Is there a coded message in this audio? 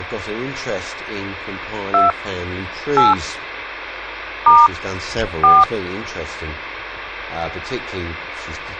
Yes: DTMF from 1.9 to 5.6 s, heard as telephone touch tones, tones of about 200 ms. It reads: 2 8 * 4